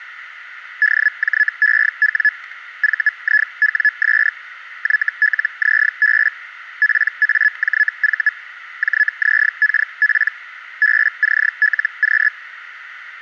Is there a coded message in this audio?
Yes: Hellschreiber (Feld-Hell, 122.5 baud) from 0.8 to 12.3 s, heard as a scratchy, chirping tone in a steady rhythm, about 1700 Hz. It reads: DJEW VIWS YLZB PAJV JZKP BCLQ